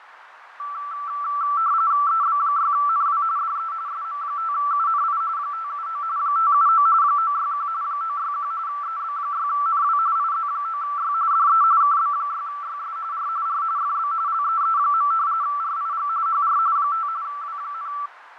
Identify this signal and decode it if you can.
RTTY (45.45 baud, 170 Hz shift), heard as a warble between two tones, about 1240 Hz centre, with radio static, fading and a narrow filter. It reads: EB6NW DE SM5UNI 579 579 961 961 EB6NW IZ9Y DE KB6YS R R FB LEE. RIG HR 5 W,